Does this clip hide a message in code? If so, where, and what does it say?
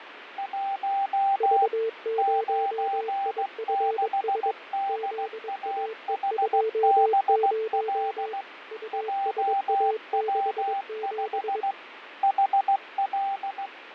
Yes: Morse code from 0.3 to 13.7 s, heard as two keyed tones, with radio static and fading. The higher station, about 16 wpm, 790 Hz: 1 96DAHBL JW5 HL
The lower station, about 22 wpm, 440 Hz: V0IFS ZAE20 USA67